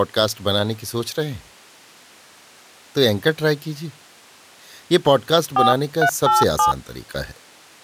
DTMF, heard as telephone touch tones, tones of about 120 ms, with speech in Urdu. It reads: 4387